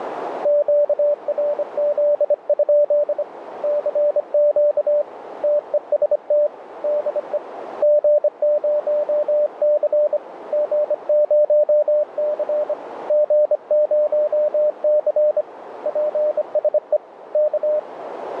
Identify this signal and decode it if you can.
Morse code, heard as a keyed tone, hand-sent with a bug key, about 25 wpm, 600 Hz, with radio static and a narrow filter. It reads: QRZ? CQ TEST DE G0C G0C G0C PSE K